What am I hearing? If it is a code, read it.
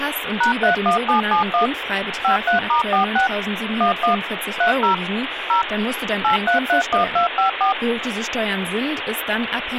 DTMF, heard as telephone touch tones, dialled by machine, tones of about 120 ms, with phone line noise and speech in German. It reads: #31771 53*46 11 30 0 8331254